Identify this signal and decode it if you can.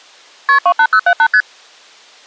Multi-frequency trunk signalling (R1, as on North American trunks), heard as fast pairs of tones, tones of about 70 ms. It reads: KP 28078 ST